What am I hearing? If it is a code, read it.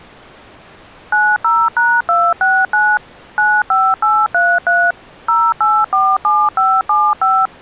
DTMF, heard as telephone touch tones, dialled by machine, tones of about 240 ms. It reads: 90#269 95833 0847575